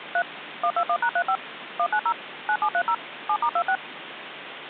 DTMF, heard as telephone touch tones, dialled by machine, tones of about 70 ms, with phone line noise. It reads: 3 121#35 190 9730 7*26